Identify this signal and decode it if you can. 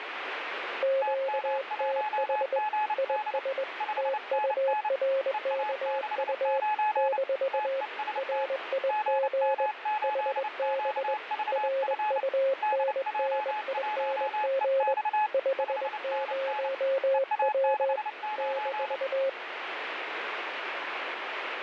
Morse code, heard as two keyed tones, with radio static. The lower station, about 21 wpm, 540 Hz: QTH IS TURKU - RIG HB RUNNING 50W -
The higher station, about 29 wpm, 850 Hz: TM1GD 5NN EA69 TEST GM8QVF DJ1EX 5NN EA69